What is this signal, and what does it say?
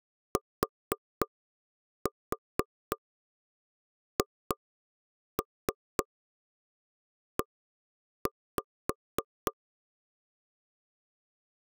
Tap code, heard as knocks on wood, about 3 knocks a second. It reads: THE